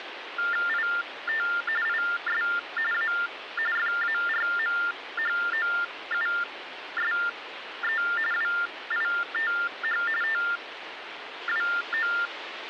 TTY/TDD text telephone tones (45.45 baud Baudot), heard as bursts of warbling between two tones, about 400 Hz shift, 1600 Hz centre, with phone line noise. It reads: IT IS A FARMHOUSE WITH TWO